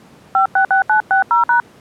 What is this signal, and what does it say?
DTMF, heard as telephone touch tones, dialled by hand, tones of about 110 ms. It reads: 566960#